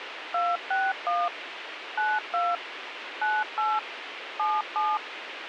DTMF, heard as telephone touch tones, dialled by machine, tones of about 210 ms, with radio hiss. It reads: 261 92 98 77